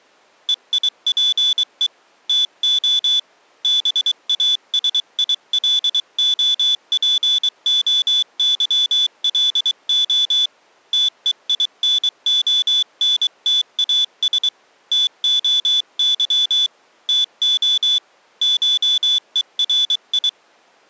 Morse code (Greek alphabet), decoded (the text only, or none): ΕΙΠΕ ΤΟ ΒΑΣΙΛΟΠΟΥΛΟ ΤΕΙΝΟΝΤΑΣ ΤΟΥ ΤΟ ΧΕΡΙ